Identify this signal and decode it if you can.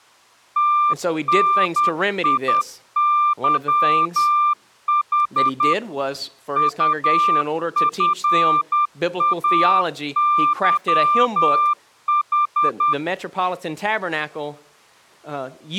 Morse code, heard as a keyed tone, machine-sent, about 10 wpm, 1190 Hz, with speech in English. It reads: TNIYH UFAYH